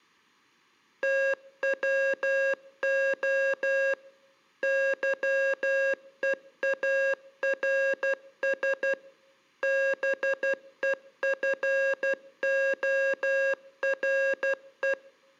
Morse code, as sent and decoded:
- .-- --- / -.-- . .- .-. ... / -... . ..-. --- .-. .
TWO YEARS BEFORE

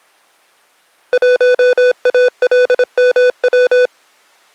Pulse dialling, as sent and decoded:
none

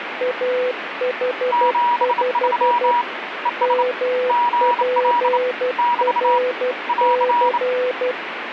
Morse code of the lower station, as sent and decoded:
.- .... ..... / -- .--. .-. -.-.
AH5 MPRC

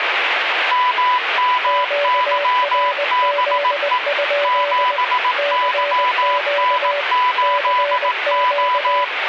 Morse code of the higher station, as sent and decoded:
-- -- -.-- -... . / --... -.-- -. ---.. ---
MMYBE 7YN8O

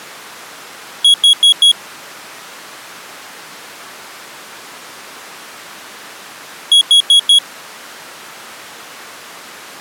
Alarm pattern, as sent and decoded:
4 beeps and a pause
temporal four

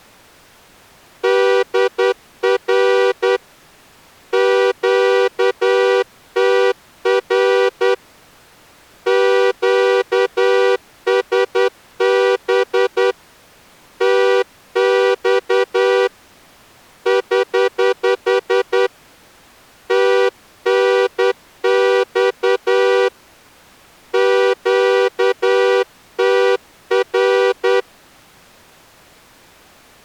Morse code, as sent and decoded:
-.. .-. / --.- - .-. / --.- ... -... / - -..- / ........ / - -. -..- / --.- - .-.
DR QTR QSB TX <HH> TNX QTR

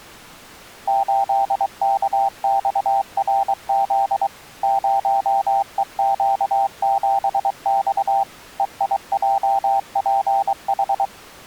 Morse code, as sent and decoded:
---.. -.- -..- .-. --.. / ----- . --.- --... -..- / . .. .--- .--. ....
8KXRZ 0EQ7X EIJPH

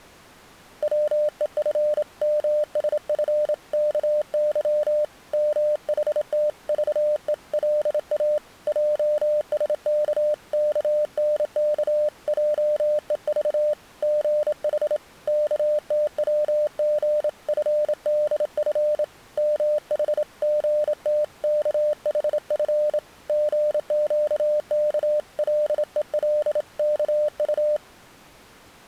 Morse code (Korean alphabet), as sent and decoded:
.-- . ..-. -- ... ..-. -.- -.-- / -- .... - ...- . .-.. .- / .--- ... -.- -.- -. -.- .--- . ...- / --. .... / -.- - .-- --. ..-. -.. ..-. / -- .... --. - -.- .... ..-. / --. --.- -.- .-.. . .-.. -.- ..-
반면에 뭐라고 형용할 수 없는 무서운 생각이

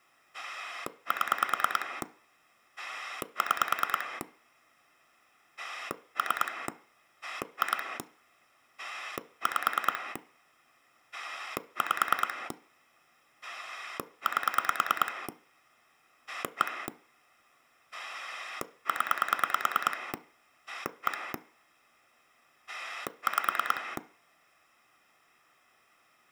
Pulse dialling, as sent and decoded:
7 / 6 / 3 / 2 / 5 / 5 / 8 / 1 / 10 / 1 / 5
7 6 3 2 5 5 8 1 0 1 5

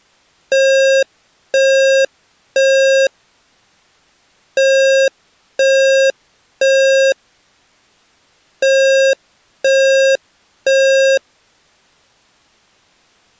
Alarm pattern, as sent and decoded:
3 beeps and a pause
temporal three

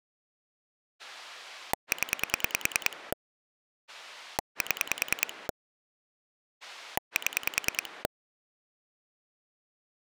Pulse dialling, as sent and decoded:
10 / 7 / 7
0 7 7

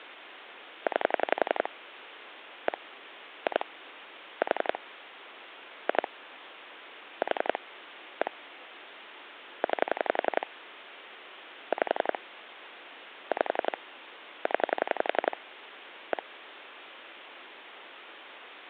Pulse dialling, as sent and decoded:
9 / 1 / 2 / 4 / 2 / 4 / 1 / 9 / 5 / 5 / 10 / 1
9 1 2 4 2 4 1 9 5 5 0 1

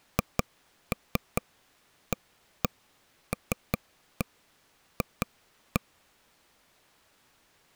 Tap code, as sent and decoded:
2-3 1-1 3-1 2-1
HALF

